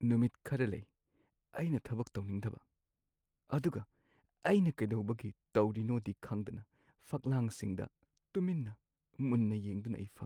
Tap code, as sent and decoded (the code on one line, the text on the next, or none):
none